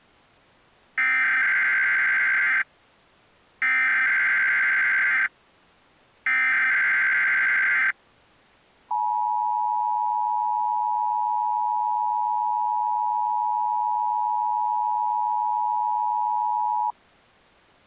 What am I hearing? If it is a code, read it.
Emergency Alert System (SAME) tones (header bursts, then the 853 and 960 Hz attention tone), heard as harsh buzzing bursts, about 520.83 baud.